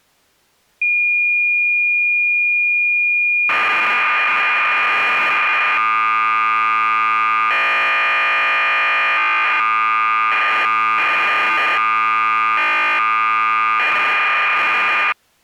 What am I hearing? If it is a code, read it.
Cassette data (Kansas City type), 1200 baud, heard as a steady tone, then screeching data.